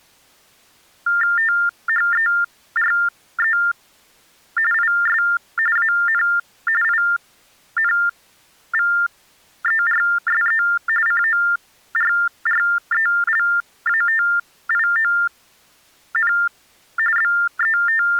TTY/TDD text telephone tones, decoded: THERE IS AN INVERSE CORRELATION …

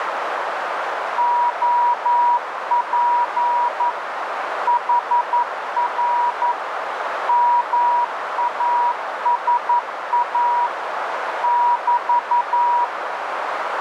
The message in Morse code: OP HR MASA <BT>

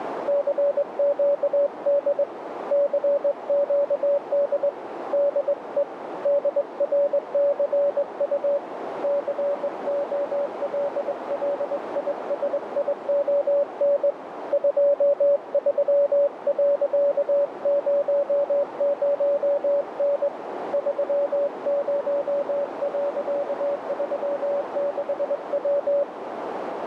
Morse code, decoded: CQD CQD DE DRCU COLLISION 23.00N 30.36W

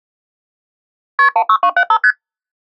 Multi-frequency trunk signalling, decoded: KP 16275 ST

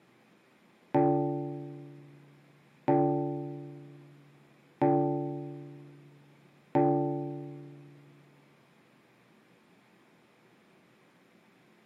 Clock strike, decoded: 4

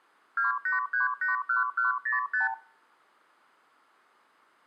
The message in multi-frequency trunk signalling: 28381105

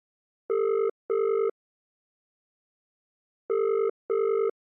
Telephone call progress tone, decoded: ringback tone

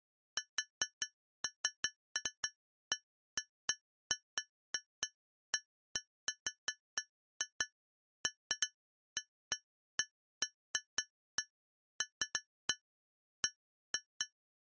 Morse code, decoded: none

